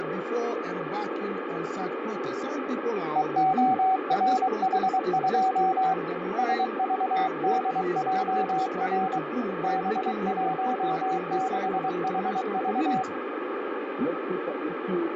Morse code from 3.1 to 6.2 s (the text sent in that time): EORH2